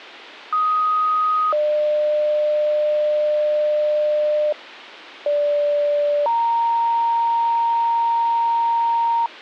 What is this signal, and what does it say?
Two-tone page, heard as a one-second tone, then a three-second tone, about 1250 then 600 Hz, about 580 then 930 Hz.